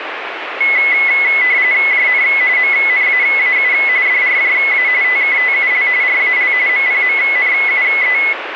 RTTY (45.45 baud, 170 Hz shift), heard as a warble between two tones, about 2100 Hz centre, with radio static. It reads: JN MNAAU DRJA TKTUL RAL MPMNUE